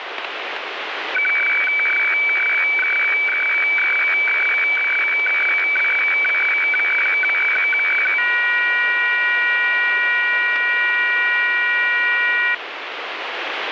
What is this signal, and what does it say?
Weather fax (radiofax), 120 lines a minute, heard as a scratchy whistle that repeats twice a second, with radio static.